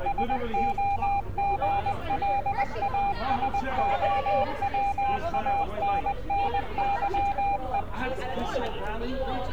Morse code (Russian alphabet), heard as a keyed tone, machine-sent, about 20 wpm, 800 Hz, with street noise. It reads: СОГЛАСОВАННЫЕ